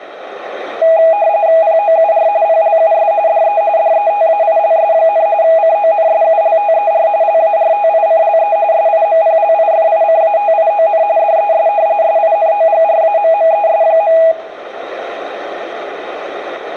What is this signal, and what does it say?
RTTY (45.45 baud, 170 Hz shift), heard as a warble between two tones, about 740 Hz centre, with radio static and room echo. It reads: POUR PLUS DE DETAILS, CONSULTER LARTICLE SIMPLIFICATION DES SINOGRAMMES.